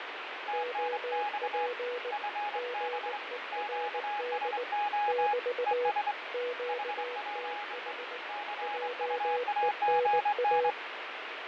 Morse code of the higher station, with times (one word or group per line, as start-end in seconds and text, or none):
0.5-1.7 TNX
2.1-3.2 FB
3.5-5.3 QSO
5.7-6.1 ES
6.7-7.9 HPE
8.3-10.7 CUAGN